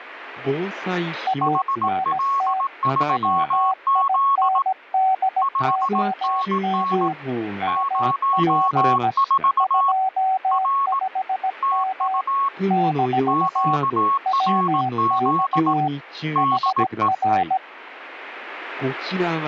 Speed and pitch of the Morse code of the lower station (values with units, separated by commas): 17 wpm, 760 Hz